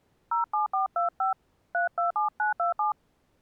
DTMF, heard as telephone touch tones, dialled by hand, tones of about 130 ms. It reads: 07425 327927